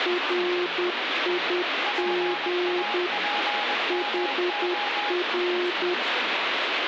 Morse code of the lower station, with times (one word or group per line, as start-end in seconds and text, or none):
0.1-3.1 RIG
3.9-5.9 HR